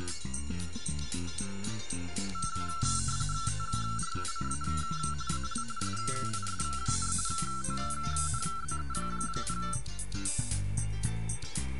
RTTY (45.45 baud, 170 Hz shift), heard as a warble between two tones, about 1430 Hz centre. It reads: TRUCA AL SIS, ONZE,